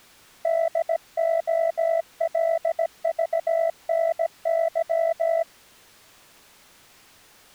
Morse code (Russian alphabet), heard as a keyed tone, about 17 wpm, 660 Hz. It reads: ДОЛЖНЫ